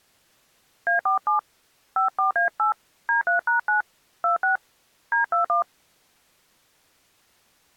DTMF, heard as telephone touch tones, dialled by hand, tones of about 120 ms. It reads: A47 54A8 D3#9 26 D21